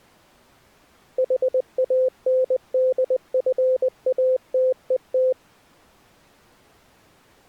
Morse code, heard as a keyed tone, machine-sent, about 20 wpm, 520 Hz. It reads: HANDFATET